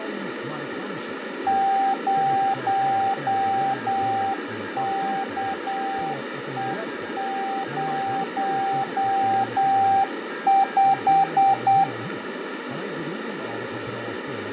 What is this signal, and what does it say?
Morse code, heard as a keyed tone, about 8 wpm, 780 Hz, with radio static, fading, a weaker station near 1620 Hz and speech in Swedish. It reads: 0KE05